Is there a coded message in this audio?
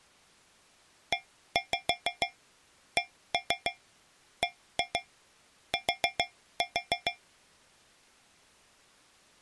Yes: tap code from 1.1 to 7.2 s, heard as taps on a metal pipe, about 6 knocks a second. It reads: ECBT